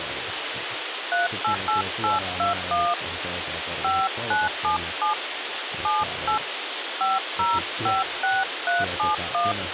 DTMF, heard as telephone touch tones, dialled by hand, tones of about 170 ms, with phone line noise and speech in Finnish. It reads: 388821 5977 78 5056371